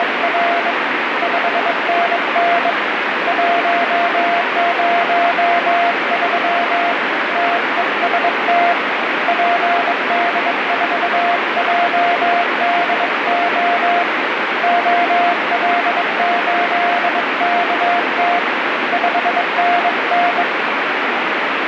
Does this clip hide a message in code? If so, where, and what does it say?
Yes: Morse code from 0.0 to 20.5 s, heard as a keyed tone, hand-sent with a bug key, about 22 wpm, 700 Hz, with heavy radio static. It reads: … 5NN 103 TEST PD4JDO OL8KT 5NN